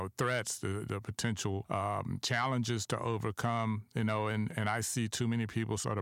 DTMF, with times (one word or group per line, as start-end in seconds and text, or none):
none